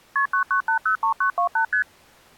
Multi-frequency trunk signalling (R1, as on North American trunks), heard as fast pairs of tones, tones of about 100 ms. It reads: KP 99803928 ST